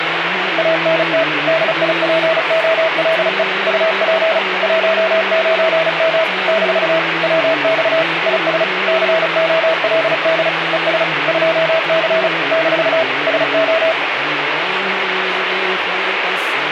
Morse code, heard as a keyed tone, machine-sent, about 35 wpm, 650 Hz, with radio static. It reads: ANT DIPOLE UP 19M - WX IS COLD ES 2C - SO